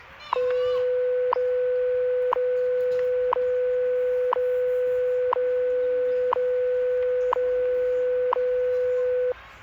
Radio time signal (WWV, Colorado), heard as ticks, one a second, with static crashes and the noise of a park.